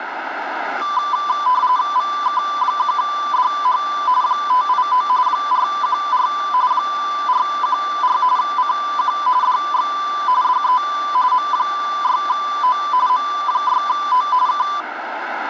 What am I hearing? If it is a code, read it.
RTTY (45.45 baud, 170 Hz shift), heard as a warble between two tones, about 1090 Hz centre, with radio static. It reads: VK1DH 589 414 414 CQ DX DE M6O M6O K